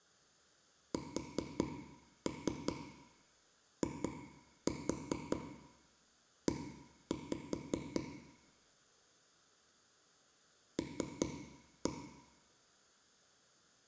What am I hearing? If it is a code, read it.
Tap code, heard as taps on a table, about 5 knocks a second, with room echo. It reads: SIE L